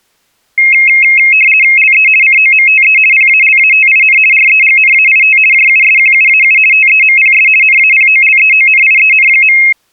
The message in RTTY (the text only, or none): LE COMTE PALATIN REGNAIT JUSQUAU TEMPS NAPOLEONIEN.